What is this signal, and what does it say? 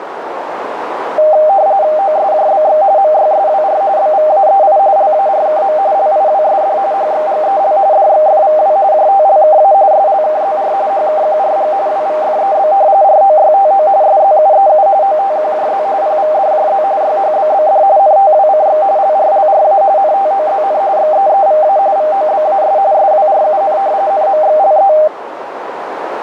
RTTY (45.45 baud, 170 Hz shift), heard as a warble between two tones, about 700 Hz centre, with radio static and a narrow filter. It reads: OSJBX MYSWR BVAEI LARKM LIWSD HXGEL DXFVW JTLKA SLKZR HKQRG WVFEB ROYTO SZUEU OTQJZ PVDJZ YHBBD NTWCX LRLRA NTOZN XEEVA VOBAS SWRUN NMXLE